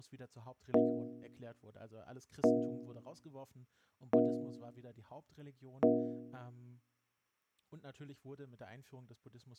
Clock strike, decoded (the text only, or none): 4